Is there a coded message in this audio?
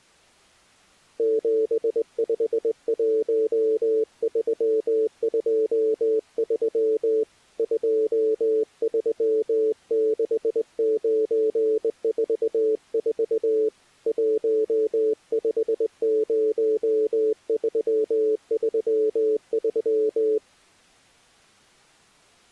Yes: Morse code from 1.1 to 20.4 s, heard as a keyed tone, hand-sent with a straight key, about 20 wpm, 440 Hz. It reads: 751323 236944 150333